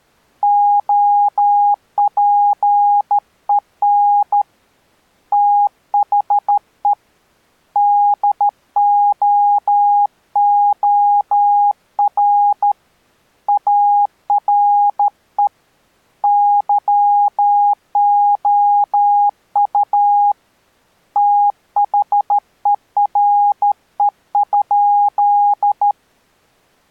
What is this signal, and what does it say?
Morse code, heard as a keyed tone, hand-sent with a straight key, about 13 wpm, 820 Hz. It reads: OPEN THE DOOR ARE YOU THERE?